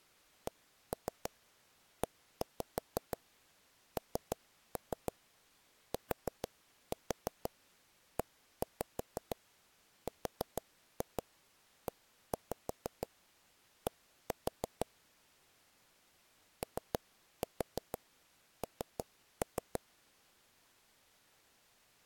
Tap code, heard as taps on a table, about 6 knocks a second. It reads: CENTERED ON